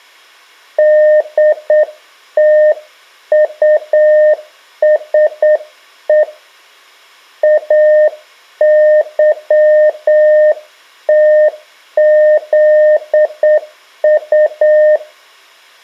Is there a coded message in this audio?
Yes: Morse code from 0.7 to 15.0 s, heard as a keyed tone, hand-sent with a straight key, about 8 wpm, 610 Hz. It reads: DTUSE AYTZU